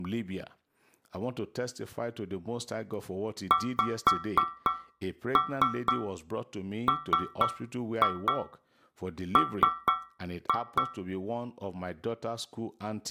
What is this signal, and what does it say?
Tap code, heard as taps on a metal pipe, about 4 knocks a second, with room echo and speech in English. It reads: XMM